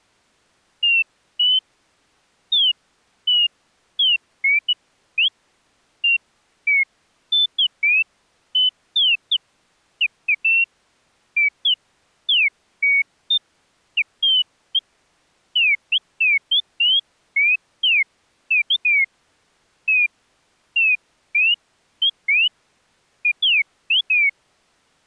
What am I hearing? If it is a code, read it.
Bird-like chirps. There is no code.